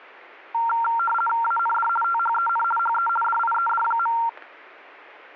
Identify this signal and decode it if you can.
RTTY (50 baud, 450 Hz shift), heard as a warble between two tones, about 1150 Hz centre. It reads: AND THEN HE DIED.